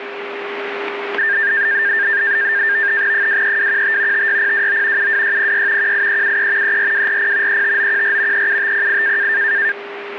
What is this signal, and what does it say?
NAVTEX (SITOR-B), 100 baud, 170 Hz shift, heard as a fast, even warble, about 1700 Hz centre, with radio static and a steady whistle near 400 Hz. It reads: 23215 56029 72606 18373 34240 35914 37508